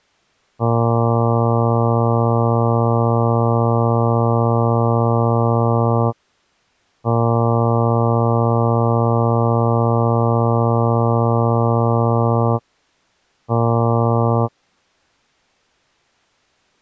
Ship horn signal, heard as a ship's horn, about 120 Hz. 2 long, 1 short. At sea: I intend to overtake on your starboard side.